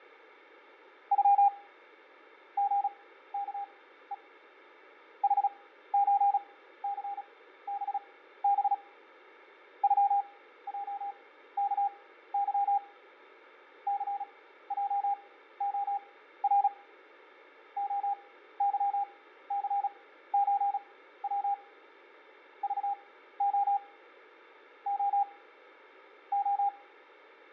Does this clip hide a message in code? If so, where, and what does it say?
Yes: Morse code (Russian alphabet) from 1.1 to 26.7 s, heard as a keyed tone, machine-sent, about 36 wpm, spaced as for 15 wpm, 800 Hz, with fading. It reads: Ю ГКЕ ХЧЦББ ЮЙКЫ ЦЙОР ОЫЦЧВ ЖО О О